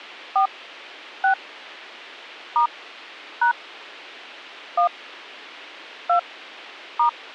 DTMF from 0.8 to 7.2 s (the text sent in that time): 6 * # 1 2 *